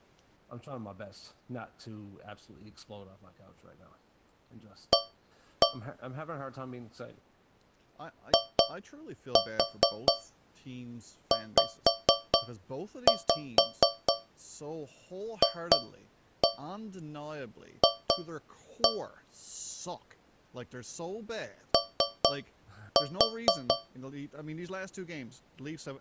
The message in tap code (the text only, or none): A IZFF O